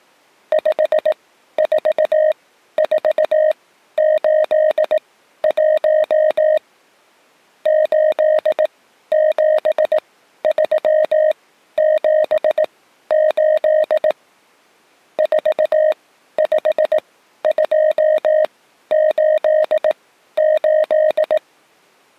Morse code, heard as a keyed tone, machine-sent, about 18 wpm, spaced as for 12 wpm, 620 Hz. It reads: 54481 87378 45288